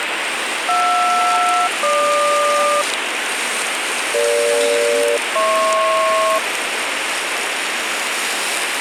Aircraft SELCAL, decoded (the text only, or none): JR-GQ EG-HP